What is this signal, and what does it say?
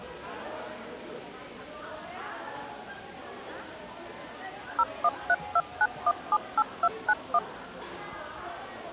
DTMF, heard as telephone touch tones, dialled by machine, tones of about 50 ms, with the noise of a crowd indoors. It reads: 01329178291